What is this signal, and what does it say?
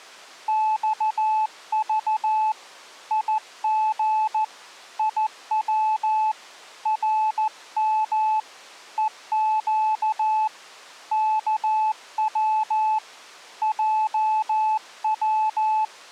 Morse code, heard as a keyed tone, hand-sent with a paddle, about 14 wpm, 870 Hz. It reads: XV IG IW RM EQ KW JW